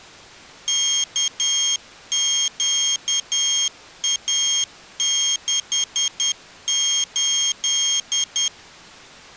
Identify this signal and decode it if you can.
Morse code, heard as a high beeper, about 10 wpm, 3200 Hz. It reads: KQA68